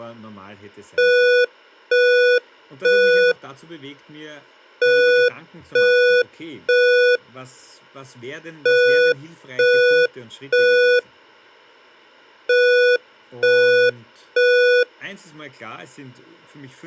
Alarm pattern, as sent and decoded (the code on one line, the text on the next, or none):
3 beeps and a pause
temporal three